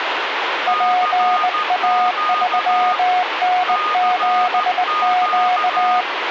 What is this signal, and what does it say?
Morse code, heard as two keyed tones, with radio static. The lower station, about 19 wpm, 730 Hz: PA3N7Q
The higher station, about 14 wpm, 1230 Hz: CQ CQ